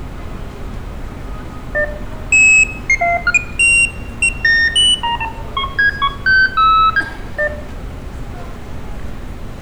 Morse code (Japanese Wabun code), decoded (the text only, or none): none